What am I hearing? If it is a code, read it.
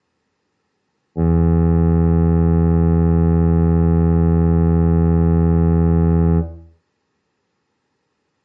Ship horn signal, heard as a ship's horn, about 80 Hz, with room echo. 1 long. At sea: a vessel nearing a blind bend, or under power and making way in fog.